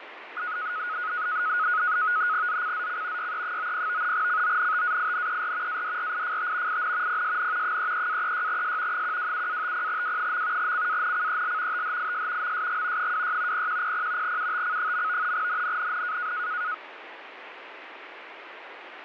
NAVTEX (SITOR-B), 100 baud, 170 Hz shift, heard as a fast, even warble, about 1360 Hz centre, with radio static. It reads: ZCZC YE90 CONTAINER ADRIFT IN PSN 33-36S 127-50W. CANCEL THIS MSG 26 0100 UTC. NNNN